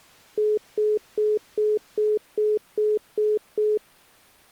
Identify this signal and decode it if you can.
Telephone call progress tone (single-tone plan, as in most of Europe), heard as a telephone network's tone, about 420 Hz, 0.2 s on and 0.2 s off. Congestion tone.